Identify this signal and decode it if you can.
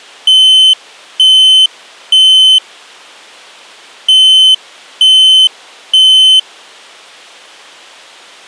Alarm pattern, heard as an alarm's beeps, played twice, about 3050 Hz. Temporal three. Smoke or fire, evacuate.